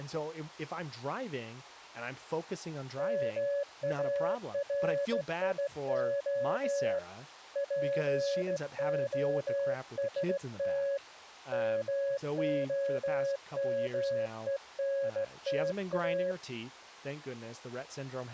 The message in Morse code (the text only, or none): MARIO POST MOMENTA